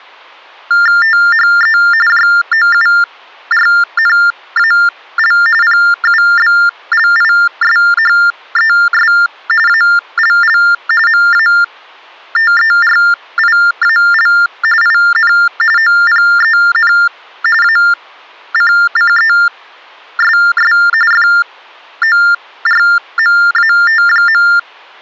TTY/TDD text telephone tones (45.45 baud Baudot), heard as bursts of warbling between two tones, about 400 Hz shift, 1600 Hz centre. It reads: THE JOURNAL PUBLISHES ALL MATERIAL IN OPEN ACCESS FORMAT.